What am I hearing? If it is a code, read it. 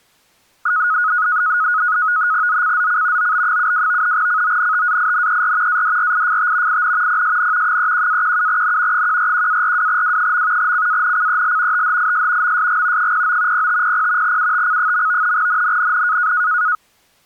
NAVTEX (SITOR-B), 100 baud, 170 Hz shift, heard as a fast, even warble, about 1360 Hz centre. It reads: ZCZC OB72 CONTAINER ADRIFT IN PSN 31-17N 141-42W. CANCEL THIS MSG 09 0500 UTC. NNNN